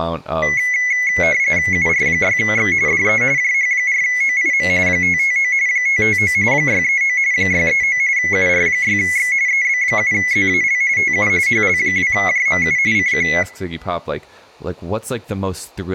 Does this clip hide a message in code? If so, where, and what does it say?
Yes: RTTY (45.45 baud, 170 Hz shift) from 0.4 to 13.4 s, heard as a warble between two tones, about 2100 Hz centre, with speech in English. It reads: UR6X DE JH4OIM 559 559 639 639 UR6X EB7ZAL TU HL2JMU CQ